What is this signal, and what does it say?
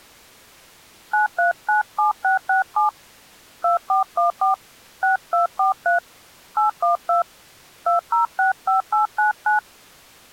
DTMF, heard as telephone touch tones, dialled by hand, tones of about 130 ms. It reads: 9397667 2414 6243 812 2065899